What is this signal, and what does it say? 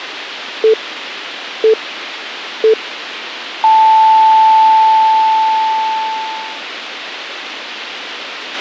Radio time signal (three low pips and a long one an octave up, as on NHK), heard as pips, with a squelch burst at the end.